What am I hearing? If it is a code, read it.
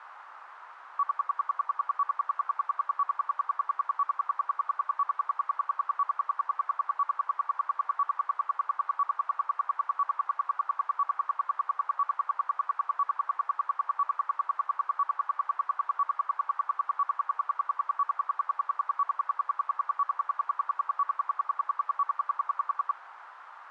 Radio time signal (RWM, Moscow), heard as ten pulses a second, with radio static.